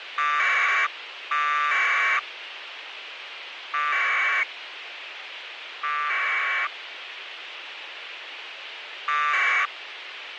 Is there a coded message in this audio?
Yes: packet radio (AX.25, as in APRS), 1200 baud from 0.2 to 9.7 s, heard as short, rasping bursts, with radio hiss.